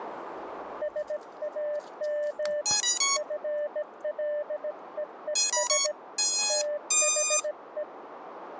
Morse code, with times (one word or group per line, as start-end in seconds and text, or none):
0.8-2.6 SAM
3.2-5.9 FLEES
6.5-7.8 THE